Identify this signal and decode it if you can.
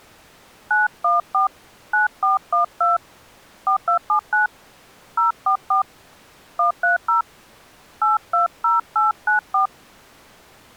DTMF, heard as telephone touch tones, dialled by hand, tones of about 140 ms. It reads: 914 9412 4279 044 130 820894